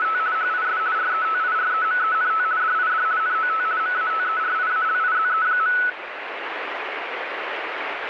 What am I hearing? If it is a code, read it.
RTTY (50 baud, 170 Hz shift), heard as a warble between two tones, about 1390 Hz centre, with radio static. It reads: … HIS RETIREMENT DID NOT MATERIALIZE.